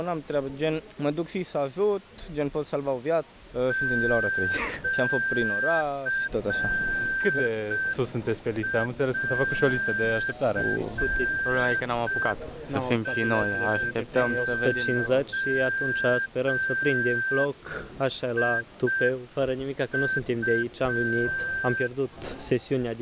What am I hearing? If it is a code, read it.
Morse code (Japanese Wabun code), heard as a whistle, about 5 wpm. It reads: シンゴウ